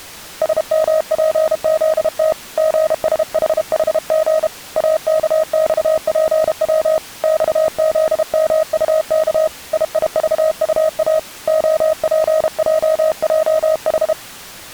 Morse code, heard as a keyed tone, hand-sent with a paddle, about 32 wpm, 630 Hz. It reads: SMPZT GSHHG AKXPW XZMUK IIVUA OPJJH